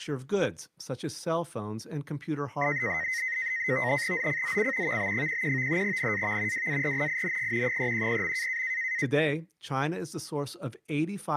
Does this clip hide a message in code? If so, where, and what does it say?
Yes: NAVTEX (SITOR-B), 100 baud, 170 Hz shift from 2.6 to 9.1 s, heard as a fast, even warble, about 1950 Hz centre, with speech in English. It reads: ZCZC VB11 NAV WARNING 310.